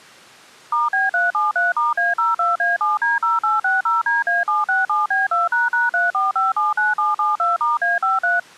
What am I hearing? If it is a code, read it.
DTMF, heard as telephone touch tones, dialled by machine, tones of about 170 ms. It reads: *B373*A02A7D0860DA767B2##34579772*A53